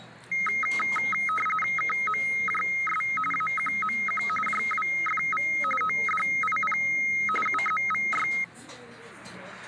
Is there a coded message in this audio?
Yes: RTTY (45.45 baud, 850 Hz shift) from 0.3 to 8.4 s, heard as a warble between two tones, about 1700 Hz centre, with the noise of a restaurant. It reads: KMJS AQMQ JWFV ODIP UZVY